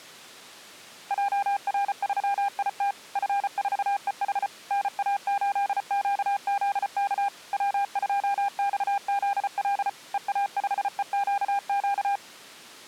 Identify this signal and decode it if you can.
Morse code, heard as a keyed tone, machine-sent, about 34 wpm, 800 Hz. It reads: JR3IT F4EH NA8QZK W2XZL EA5EQQ